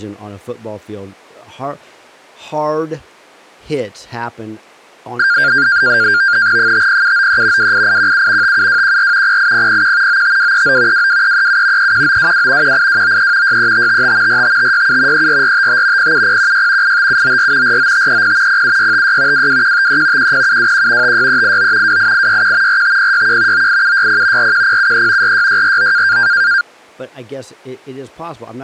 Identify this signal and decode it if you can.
NAVTEX (SITOR-B), 100 baud, 170 Hz shift, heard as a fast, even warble, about 1500 Hz centre, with speech in English. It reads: 50793 28817 57214 08001 95239 22337 31922 18293 63555 45567 34455 07016 85794 49530 07656 22153 10721 56389 28861 45061 98760 41073 46649